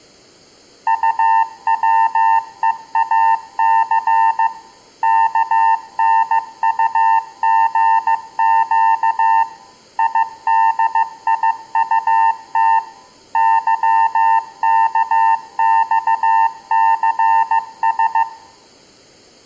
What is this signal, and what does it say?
Morse code, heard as a keyed tone, machine-sent, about 15 wpm, 900 Hz, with room echo. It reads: UWEAC KNUGQ IDIUT YKXCS